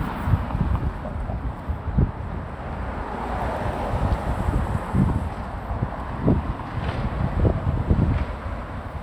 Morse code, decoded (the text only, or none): none